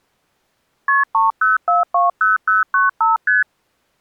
Multi-frequency trunk signalling (R1, as on North American trunks), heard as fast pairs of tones, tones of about 160 ms. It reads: KP 30420095 ST